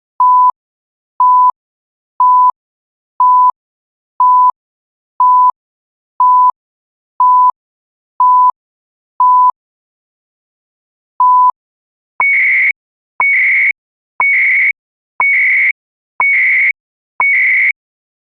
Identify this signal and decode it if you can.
Radio time signal (CHU, Canada), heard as beeps and data bursts, one a second.